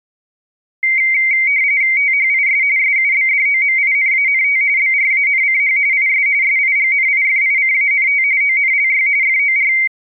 RTTY (45.45 baud, 170 Hz shift), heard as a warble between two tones, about 2150 Hz centre. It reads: THIS SUBDOMINANT BRANCH IS SIGNIFICANT ONLY FOR